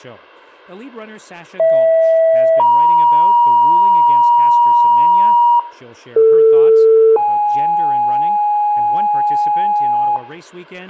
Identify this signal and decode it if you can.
Two-tone page, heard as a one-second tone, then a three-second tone, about 650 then 950 Hz, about 450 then 830 Hz, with a squelch burst at the end, room echo and speech in English.